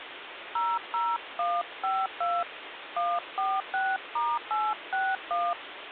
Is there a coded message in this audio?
Yes: DTMF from 0.6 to 5.5 s, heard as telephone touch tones, dialled by hand, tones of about 220 ms, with phone line noise. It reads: 00152 146*861